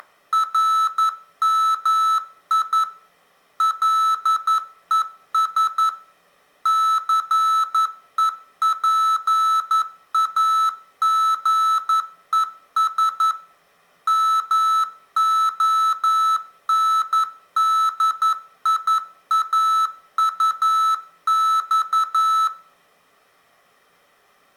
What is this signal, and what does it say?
Morse code, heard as electronic beeps, machine-sent, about 11 wpm, 1310 Hz, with room echo. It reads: … LES CEPAGES MONDIAUX